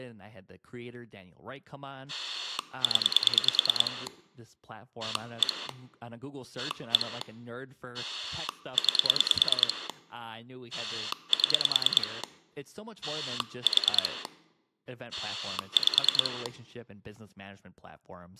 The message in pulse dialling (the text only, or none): 0 1 1 9 7 4 5